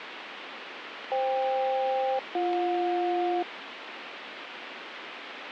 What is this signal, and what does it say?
Aircraft SELCAL, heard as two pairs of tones, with radio static. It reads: FK-BJ